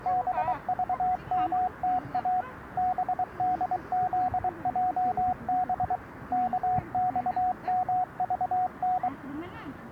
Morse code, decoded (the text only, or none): BVMTA BDZJB KXMVN